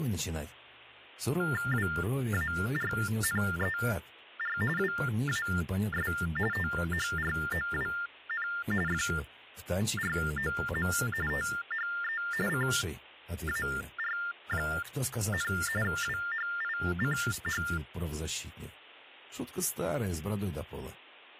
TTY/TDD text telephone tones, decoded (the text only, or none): WARNER WAS THROWN FROM THE CAR, WHICH